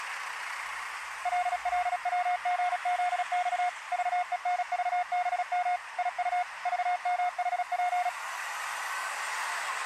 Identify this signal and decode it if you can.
Morse code, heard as a keyed tone, machine-sent, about 36 wpm, 720 Hz, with street noise. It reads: LLWGZX VENVBM IU VMHP